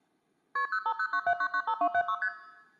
Multi-frequency trunk signalling (R1, as on North American trunks), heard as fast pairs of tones, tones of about 70 ms, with room echo. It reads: KP 05097995276 ST